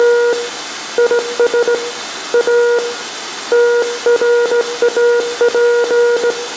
Morse code, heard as a keyed tone, hand-sent with a straight key, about 17 wpm, 480 Hz, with room echo. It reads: … IS A TRAP